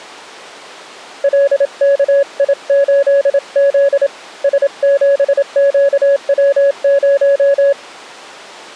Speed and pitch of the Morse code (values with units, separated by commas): 27 wpm, 560 Hz